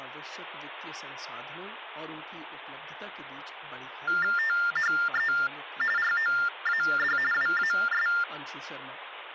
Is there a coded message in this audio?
Yes: TTY/TDD text telephone tones (45.45 baud Baudot) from 4.1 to 8.2 s, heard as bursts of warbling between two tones, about 400 Hz shift, 1600 Hz centre, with phone line noise and speech in Hindi. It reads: THE ROAD WAS